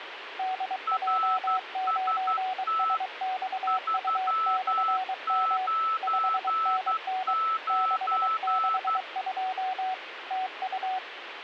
Morse code, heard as two keyed tones, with radio static. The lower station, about 23 wpm, 750 Hz: DJ9SXU/M 5NN 662 TU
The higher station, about 12 wpm, 1310 Hz: RST 399